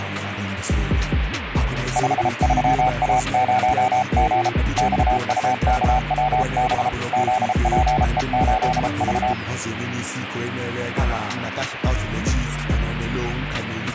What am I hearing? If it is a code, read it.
Morse code, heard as a keyed tone, hand-sent with a paddle, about 33 wpm, 760 Hz, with radio static. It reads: 53A0G XUKWB ZPE8V